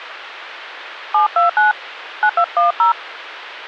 DTMF, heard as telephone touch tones, dialled by hand, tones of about 100 ms. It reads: 729 9210